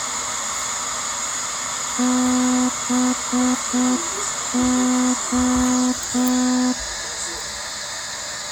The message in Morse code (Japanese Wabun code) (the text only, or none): ハレ